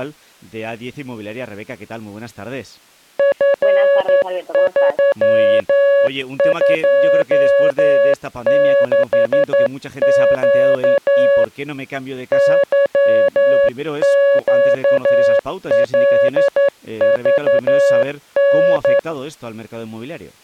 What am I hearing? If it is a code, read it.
Morse code, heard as a keyed tone, hand-sent with a straight key, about 11 wpm, 560 Hz. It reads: F326Q YQLVN